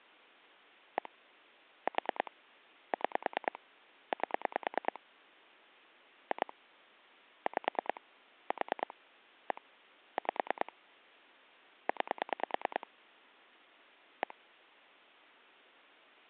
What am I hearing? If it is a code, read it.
Pulse dialling, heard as clicks on a phone line, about 9 pulses a second. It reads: 1 4 6 8 2 5 4 1 5 9 1